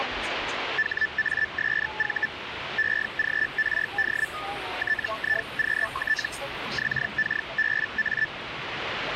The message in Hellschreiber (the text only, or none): HASV EGRD TIQT XKBA